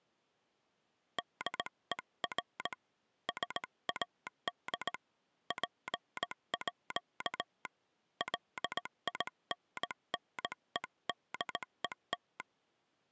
Morse code (with Danish letters), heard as a telegraph sounder, hand-sent with a straight key, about 18 wpm. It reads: DER SAD PÅ LINNEDET